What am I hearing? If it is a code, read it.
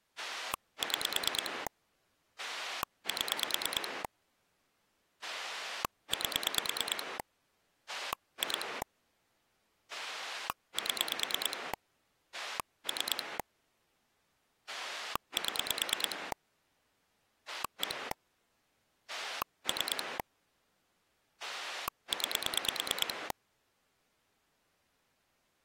Pulse dialling, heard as a rotary dial, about 9 pulses a second. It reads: 6 7 8 2 7 3 7 1 3 9